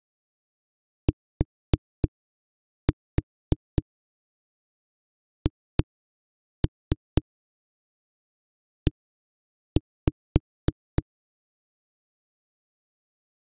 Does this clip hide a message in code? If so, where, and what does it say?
Yes: tap code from 1.1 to 11.0 s, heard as knocks on a wall, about 3 knocks a second. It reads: THE